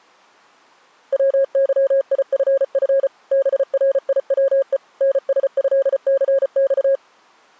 Morse code (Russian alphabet), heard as a keyed tone, machine-sent, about 34 wpm, 540 Hz. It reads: ВЫИФФ БРИВЕ НСЭЦЬ